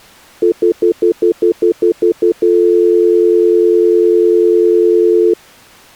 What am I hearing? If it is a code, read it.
Telephone call progress tone (North American plan), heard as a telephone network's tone, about 350, 440 Hz, 0.1 s on and 0.1 s off. Stutter dial tone.